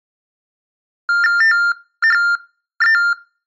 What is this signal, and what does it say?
TTY/TDD text telephone tones (45.45 baud Baudot), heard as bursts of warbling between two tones, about 400 Hz shift, 1600 Hz centre. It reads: THE